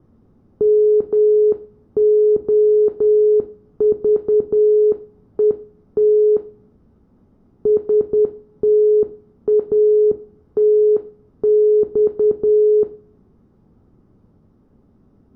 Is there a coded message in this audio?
Yes: Morse code (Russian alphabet) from 0.5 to 12.9 s, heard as a keyed tone, hand-sent with a paddle, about 10 wpm, 420 Hz, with room echo. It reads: МОЖЕТ СТАТЬ